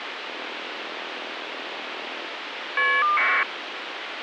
Caller ID data burst, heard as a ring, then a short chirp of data, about 1200 baud, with phone line noise.